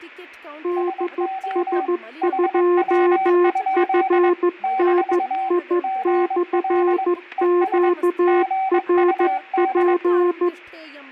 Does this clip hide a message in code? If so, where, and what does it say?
Yes: Morse code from 0.6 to 10.5 s, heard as two keyed tones, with fading, static crashes and speech in Sanskrit. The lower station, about 14 wpm, 350 Hz: DS2FNI/QRP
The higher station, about 22 wpm, 770 Hz: SO HW? - GL ES GUD